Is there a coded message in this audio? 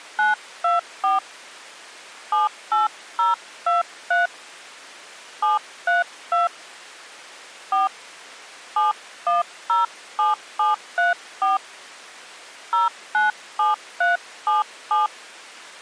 Yes: DTMF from 0.2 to 15.1 s, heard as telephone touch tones, dialled by hand, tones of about 150 ms. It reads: 924 78023 732 4 7107734 097377